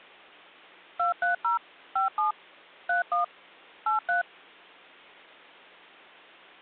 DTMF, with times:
1.0-1.6 230
2.0-2.3 57
2.9-3.2 31
3.9-4.2 83

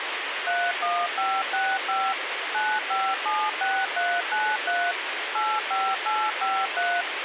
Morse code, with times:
none

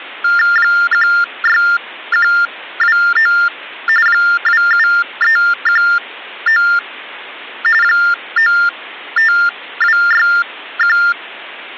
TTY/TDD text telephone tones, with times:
0.6-3.3 16129
4.1-6.6 27319
7.8-11.0 95261

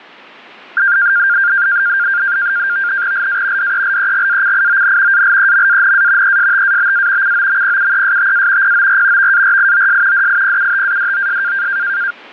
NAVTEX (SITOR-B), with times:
3.1-3.7 LA
3.6-5.2 DELEGACION
5.1-6.4 ALEMANA
6.2-7.3 ESTABA
7.2-8.7 COMPUESTA
8.6-9.3 POR
9.2-10.3 VARIOS
10.1-11.7 DIPUTADOS

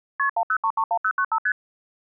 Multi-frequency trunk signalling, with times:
0.2-0.3 KP
0.4-1.4 10331095
1.5-1.5 ST

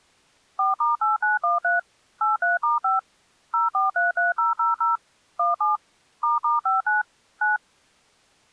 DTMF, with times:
0.6-1.8 4*8913
2.2-3.0 83*5
3.5-5.0 0433000
5.4-5.8 17
6.2-7.0 **59
7.4-7.6 9

